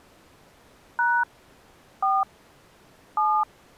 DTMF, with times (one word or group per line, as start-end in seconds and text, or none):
1.0-1.2 #
2.0-2.2 4
3.2-3.4 7